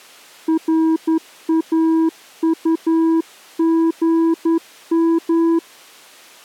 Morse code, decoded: RAUGM

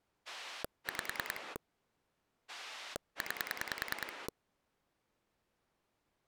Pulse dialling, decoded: 5 9

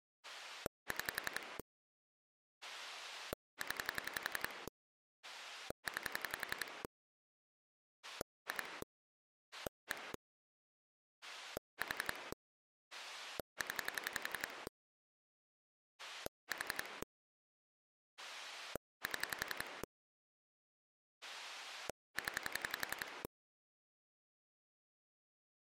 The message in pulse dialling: 6 0 9 2 1 4 0 4 7 0

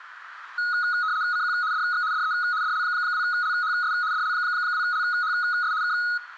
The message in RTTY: CQ DX DE DL2LHS DL2LHS K

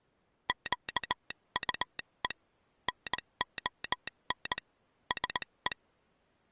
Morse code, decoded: QUE NON SE

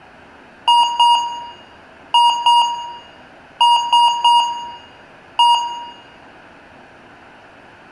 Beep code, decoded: 2-2-3-1

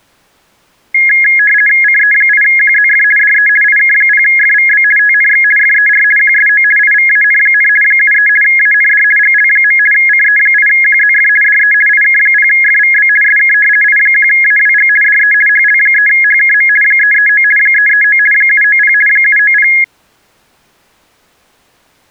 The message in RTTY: CE8QZF DE IK0FVB TNX FER QSO IVAN, 73 AND GL. CE8QZF DE IK0FVB SK I1AWG DE HL3HKM 339 339 790 790

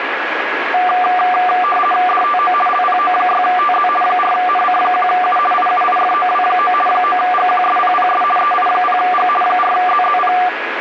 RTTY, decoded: DTO LPO6TZ 4NC1U IUIFOW9 9GQSPPS EI0G 4ZZP

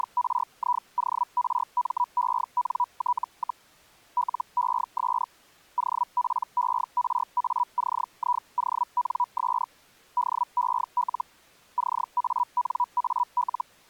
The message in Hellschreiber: … LES OPERACIONS DEL CANAL

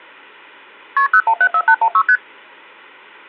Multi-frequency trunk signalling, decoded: KP 0174816 ST

